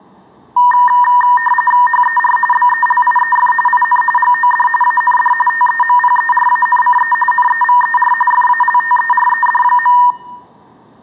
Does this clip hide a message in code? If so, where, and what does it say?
Yes: RTTY (45.45 baud, 850 Hz shift) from 0.6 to 10.1 s, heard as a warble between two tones, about 1400 Hz centre, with room echo. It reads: HER BELIEF IN GOD AND TEMPERANCE NEVER FALTERED.